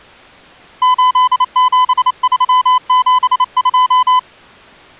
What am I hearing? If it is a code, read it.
Morse code, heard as a keyed tone, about 28 wpm, 1010 Hz. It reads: 87372